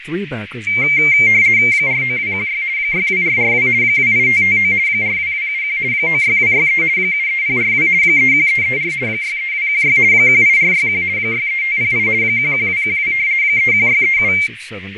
RTTY (50 baud, 170 Hz shift), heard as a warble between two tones, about 2200 Hz centre, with radio static, fading, a narrow filter and speech in English. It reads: 49216 62442 28559 42271 96263 73042 31334 63216 18461 63508 11212 31637